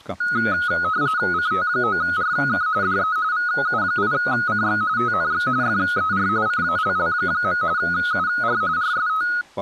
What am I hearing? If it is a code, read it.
RTTY (45.45 baud, 170 Hz shift), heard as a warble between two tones, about 1360 Hz centre, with speech in Finnish. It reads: CT9RK DE VU8CX TNX FER CALL. UR RST